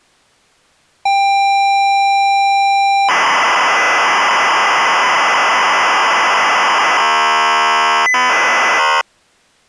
ZX Spectrum tape loading, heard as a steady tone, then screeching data.